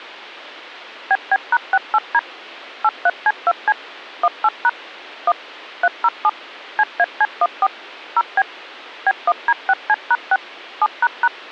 DTMF, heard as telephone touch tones, dialled by machine, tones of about 50 ms. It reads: BB#68D 83C2C 18# 1 307 CAC14 0B B1D6C#6 7##